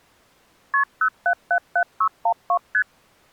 Multi-frequency trunk signalling (R1, as on North American trunks), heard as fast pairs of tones, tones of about 80 ms. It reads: KP 0777612 ST